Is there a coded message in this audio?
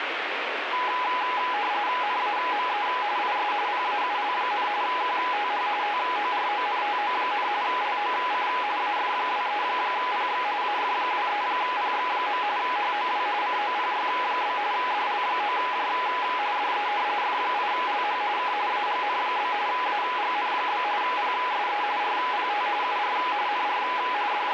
Yes: RTTY (45.45 baud, 170 Hz shift) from 0.7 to 24.5 s, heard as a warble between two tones, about 910 Hz centre, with radio static. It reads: NAME IS PAUL, QTH TORONTO, LOC AF23PX AF23PX. HOW COPY? DL9J DE F8LH K AGN? AGN? PSE RPT UR NR …